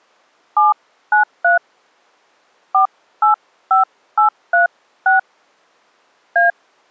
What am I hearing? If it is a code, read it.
DTMF, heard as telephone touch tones, dialled by hand, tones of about 110 ms. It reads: 793 485836 A